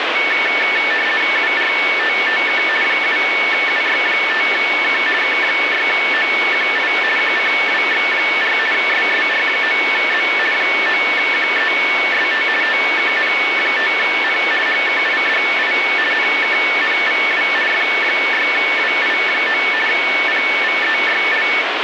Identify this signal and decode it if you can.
RTTY (50 baud, 450 Hz shift), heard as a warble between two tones, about 2000 Hz centre, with radio static. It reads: URTTK 7UY5K K6OQI QCWX4 SSR9Z 9QEST TKN5N HKIDI NKNVW F6WI9 PVEYL